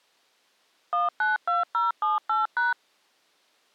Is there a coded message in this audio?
Yes: DTMF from 0.9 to 2.7 s, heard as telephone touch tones, dialled by machine, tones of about 160 ms. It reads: 192078#